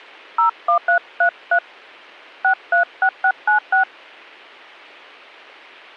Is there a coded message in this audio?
Yes: DTMF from 0.4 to 3.8 s, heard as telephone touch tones, dialled by hand, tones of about 80 ms. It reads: 01333 636696